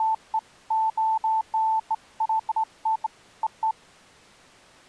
Beeps of irregular length. There is no code.